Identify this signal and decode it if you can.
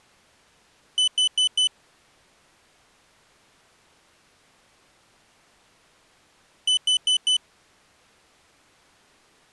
Alarm pattern, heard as an alarm's beeps, played twice, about 3000 Hz. Temporal four. Carbon monoxide.